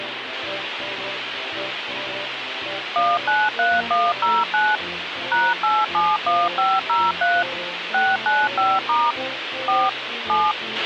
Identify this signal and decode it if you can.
DTMF, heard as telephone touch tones, dialled by machine, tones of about 220 ms, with radio hiss and a squelch burst at the end. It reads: 193109 #871503 695* 4 7